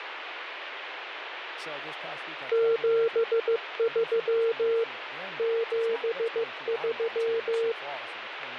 Morse code, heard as a keyed tone, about 15 wpm, 460 Hz, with radio static and speech in English. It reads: 73 73